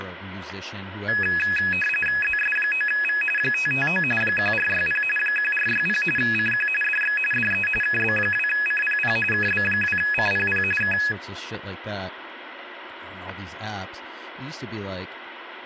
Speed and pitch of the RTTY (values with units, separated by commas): 45.45 baud, 850 Hz shift, 2100 Hz centre